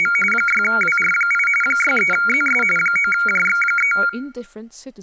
RTTY (45.45 baud, 850 Hz shift), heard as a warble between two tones, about 1800 Hz centre, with speech in English. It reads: … 6WR8 63ZS 9JX3